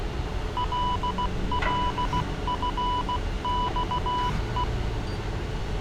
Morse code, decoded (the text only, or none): LLFXE